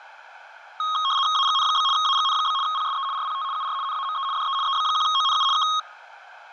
RTTY (75 baud, 170 Hz shift), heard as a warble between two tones, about 1170 Hz centre, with room echo. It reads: AGN? AGN? PSE RPT UR NAME DE EB1ONU K